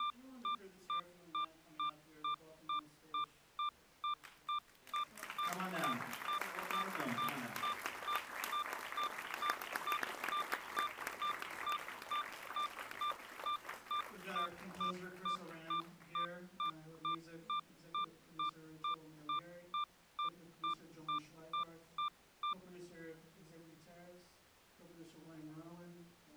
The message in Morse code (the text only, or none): none